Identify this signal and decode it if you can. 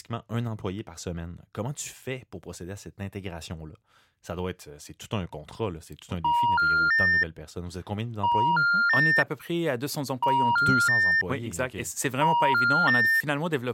Telephone call progress tone (ITU plan), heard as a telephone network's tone, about 950, 1400, 1800 Hz, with speech in French. Special information tone.